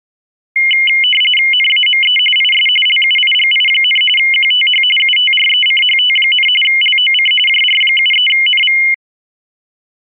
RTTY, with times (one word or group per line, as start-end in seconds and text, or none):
1.5-2.2 NAME
2.4-2.7 IS
2.9-4.0 LUIGI,
4.2-4.8 QTH
5.0-6.5 UTRECHT,
6.6-7.3 LOC
7.5-8.8 JR73NV